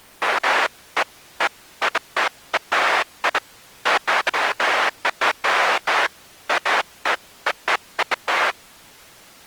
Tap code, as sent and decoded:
none

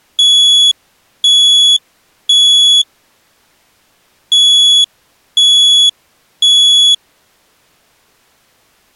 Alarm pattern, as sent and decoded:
3 beeps and a pause
temporal three

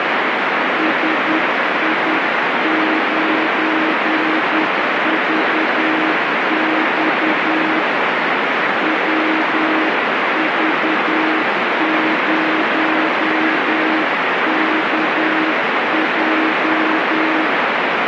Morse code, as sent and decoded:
... .. ----. ...- -..- / .-- ...- ----- -.- .---
SI9VX WV0KJ

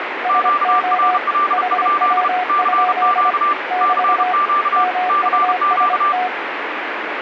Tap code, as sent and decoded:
none

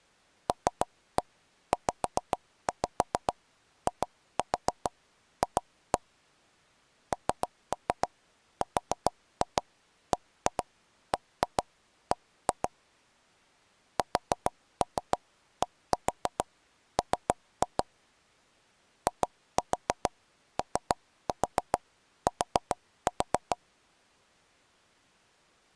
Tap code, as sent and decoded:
3-1 5-5 2-4 2-1 / 3-3 4-2 1-2 1-2 1-2 / 4-3 1-4 3-2 / 2-4 3-4 4-4
LZIF NRBBB SDM IOT

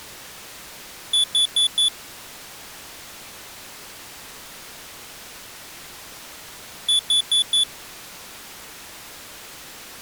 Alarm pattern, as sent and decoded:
4 beeps and a pause
temporal four

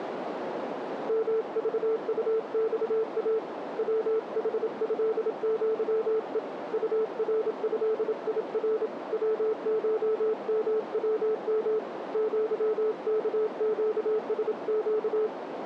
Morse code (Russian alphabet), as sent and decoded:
-- ...- ..- -..- .- / .-- .... ..-.. --.-- . / ..- .-. ..-.. .. .-. / .-- ---- -- .-- -- / --.-- -.- --.- ... --.-
МЖУЬА ВХЭЪЕ УРЭИР ВШМВМ ЪКЩСЩ

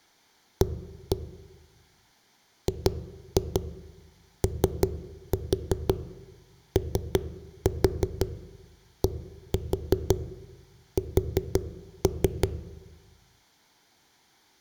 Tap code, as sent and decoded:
1-1 / 2-2 3-4 3-4 1-4 4-3
A GOODS

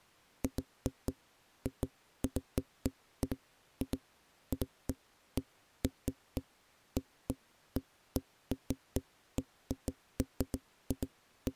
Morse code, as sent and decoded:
none

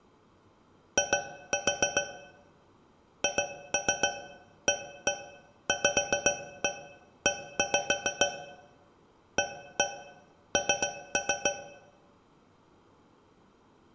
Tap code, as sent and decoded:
2-4 / 2-3 1-1 5-1 1-5 / 1-1 3-3
I HAVE AN

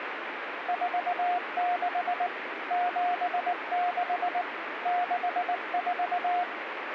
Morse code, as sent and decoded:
....- -.... / --... -.... / -.... ....-
46 76 64

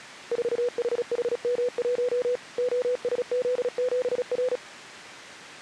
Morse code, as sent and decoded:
....- .... .... -- .---- / --- ... --.. --... .-.
4HHM1 OSZ7R

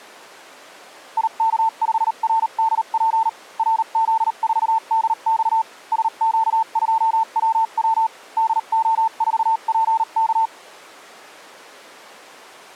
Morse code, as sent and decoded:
.. -.- ..... .-. -.. .--. / .-. --.. ....- -.. -..- / ... --.- ..--- .-- .-- / -.. --- ....- .--. -.-
IK5RDP RZ4DX SQ2WW DO4PK

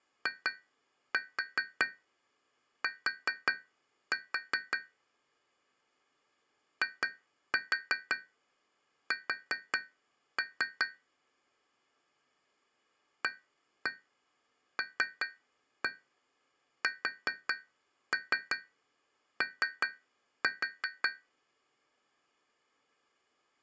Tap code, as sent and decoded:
2-4 4-4 / 2-4 4-3 / 1-1 3-1 4-3 3-4
IT IS ALSO

